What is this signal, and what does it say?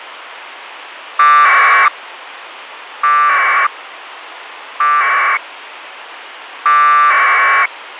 Packet radio (AX.25, as in APRS), 1200 baud, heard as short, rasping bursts, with radio hiss.